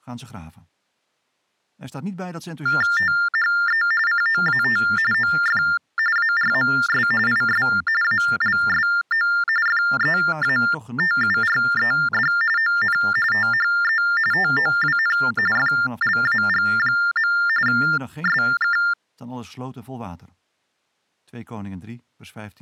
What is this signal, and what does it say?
TTY/TDD text telephone tones (45.45 baud Baudot), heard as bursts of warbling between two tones, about 400 Hz shift, 1600 Hz centre. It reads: THE COAT OF ARMS IS ALSO FEATURED ON THE TOWN FLAG. SK